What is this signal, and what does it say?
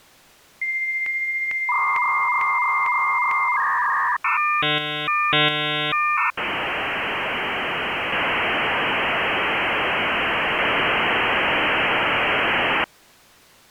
Dial-up modem handshake (V.34 or later), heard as a whistle, warbles, then hiss.